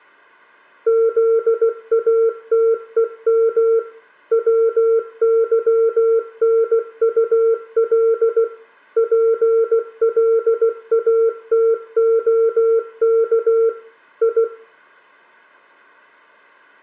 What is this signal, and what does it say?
Morse code (Russian alphabet), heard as a keyed tone, machine-sent, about 16 wpm, 450 Hz, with room echo. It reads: ЗАТЕМ ВЫНУЛ ПЛАТОК И